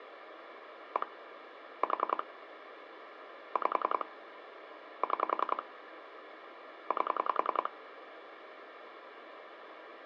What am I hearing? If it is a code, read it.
Pulse dialling, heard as clicks on a phone line, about 10 pulses a second, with phone line noise. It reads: 1 4 5 6 8